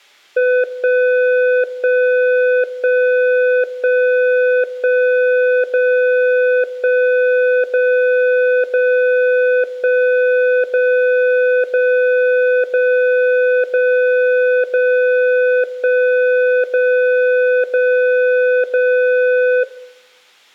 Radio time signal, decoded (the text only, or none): 1 1 1 1 1 0 1 0 0 1 0 0 0 0 0 1 0 0 0